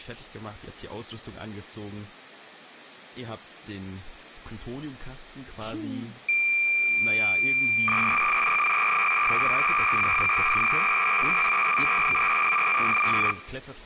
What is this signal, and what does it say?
Cassette data (Kansas City type), 300 baud, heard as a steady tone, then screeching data, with speech in German.